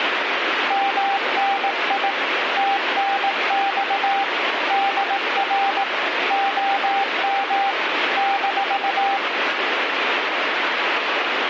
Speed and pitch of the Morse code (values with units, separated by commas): 18 wpm, 790 Hz